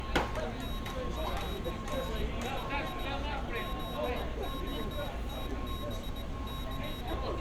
Morse code, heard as a high beeper, hand-sent with a paddle, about 19 wpm, 3800 Hz, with street noise. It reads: NGNII ZOTBC